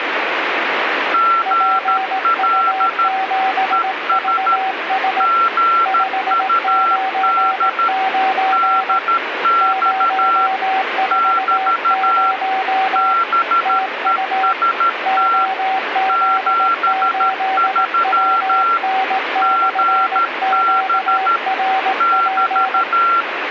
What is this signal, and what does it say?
Morse code, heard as two keyed tones, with radio static. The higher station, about 13 wpm, 1360 Hz: GL ES GUD DX <BT> BEST 73 GB <BT>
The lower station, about 18 wpm, 760 Hz: PU7VS 599 040 TU OZ8WN/QRP